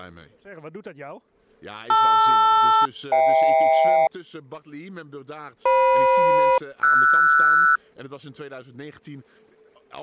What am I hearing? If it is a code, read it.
Aircraft SELCAL, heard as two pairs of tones. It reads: LR-HK FM-RS